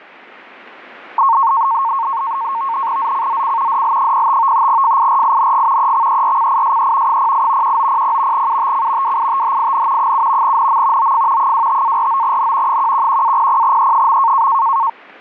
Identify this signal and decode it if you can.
NAVTEX (SITOR-B), 100 baud, 170 Hz shift, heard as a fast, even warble, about 1000 Hz centre. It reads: ZCZC DL05 FIRING EXERCISE 08 1900 UTC WITHIN 7 NM OF 25-49N 111-00E.